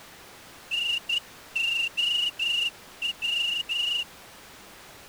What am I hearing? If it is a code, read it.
Morse code, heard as a whistle, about 12 wpm. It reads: NOW